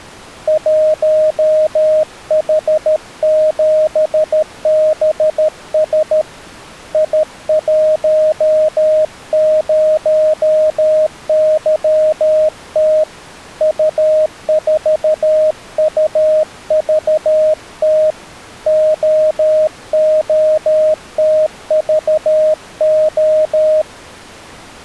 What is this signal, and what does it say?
Morse code, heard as a keyed tone, hand-sent with a paddle, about 13 wpm, 620 Hz. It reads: 1H7BS I10YT U4UVT OOTVO